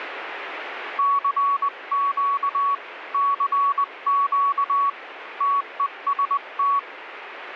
Morse code, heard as a keyed tone, hand-sent with a paddle, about 20 wpm, 1120 Hz, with radio static. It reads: CQ CQ TEST